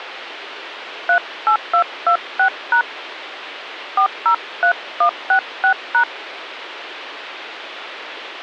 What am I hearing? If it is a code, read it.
DTMF, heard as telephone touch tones, dialled by hand, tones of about 90 ms, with phone line noise. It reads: 38226# 403166#